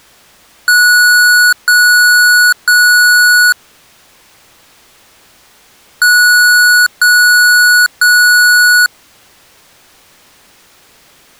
Beep code, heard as beeps from a small speaker, played twice, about 1470 Hz. 3 long. In IBM BIOS tables: keyboard card error.